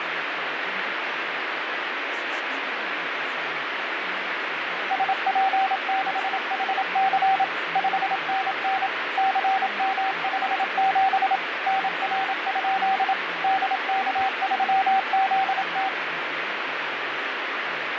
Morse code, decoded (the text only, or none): SP6HC 5NN CM57 NR? DK3ZT